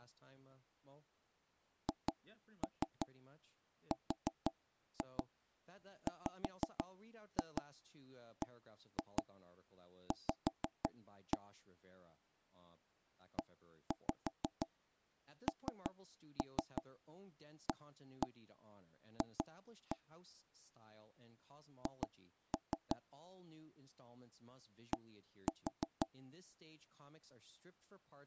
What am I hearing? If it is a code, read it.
Tap code, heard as knocks on wood, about 5 knocks a second, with speech in English. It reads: HRWBV ENAF H D